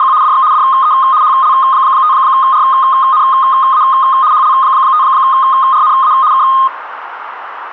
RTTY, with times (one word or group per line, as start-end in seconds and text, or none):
0.0-0.1 …
0.2-0.4 DX
0.5-0.9 DE
1.2-3.8 HL5RNA
4.3-6.1 HL5RNA
6.3-6.4 K